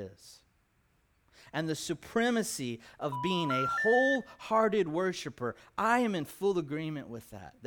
Telephone call progress tone (North American plan), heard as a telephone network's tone, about 980, 1370, 1800 Hz, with speech in English. Special information tone.